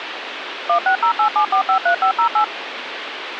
DTMF, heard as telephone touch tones, dialled by machine, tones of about 100 ms, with phone line noise. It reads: 16087453508